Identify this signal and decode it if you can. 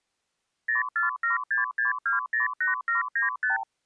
Multi-frequency trunk signalling (R2, with the far end's replies), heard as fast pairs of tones, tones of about 140 ms. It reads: 04766208795